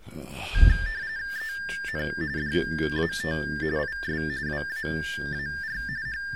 RTTY (45.45 baud, 170 Hz shift), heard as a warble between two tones, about 1700 Hz centre. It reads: EN DAT IS WAAR …